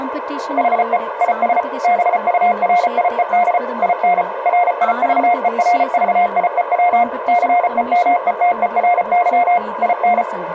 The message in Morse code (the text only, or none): HE IS BURIED IN RIVERVIEW CEMETERY IN